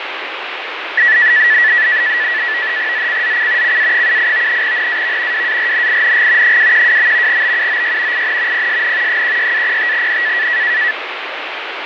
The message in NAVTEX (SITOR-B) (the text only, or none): ZCZC CA78 NAV WARNING 212. BUOY IN PSN 16-05N